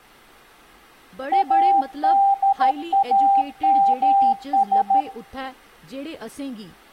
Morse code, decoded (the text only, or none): ADAMS